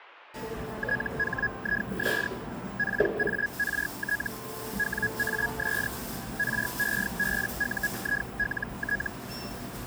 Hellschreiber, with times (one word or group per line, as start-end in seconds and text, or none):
0.8-2.3 THIS
2.8-4.3 PART
4.8-5.9 WAS
6.4-9.1 REBUILT